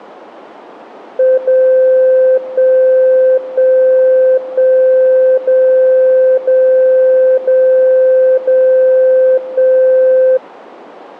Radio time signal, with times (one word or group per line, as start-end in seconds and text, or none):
1.4-2.4 0
2.4-3.4 1
3.4-4.4 1
4.4-5.4 1
5.4-6.4 0
6.4-7.4 0
7.4-8.4 0
8.4-9.4 0
9.4-10.4 1